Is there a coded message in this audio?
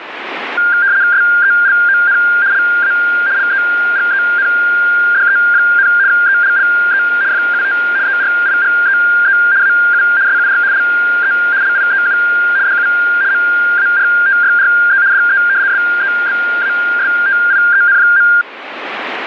Yes: RTTY (75 baud, 170 Hz shift) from 0.6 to 18.4 s, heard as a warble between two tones, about 1500 Hz centre, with radio static. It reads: SELON LA LEGENDE, ELLE FUT ERIGEE AU SUR LE LIEU DU MARTYRE DE SEBASTIEN.